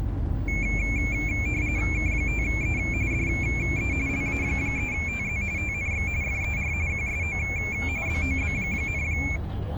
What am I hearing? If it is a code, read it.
RTTY (45.45 baud, 170 Hz shift), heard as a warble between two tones, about 2300 Hz centre, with the noise inside a bus. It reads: K5E DE LA3TZ TNX FER QSO BOB,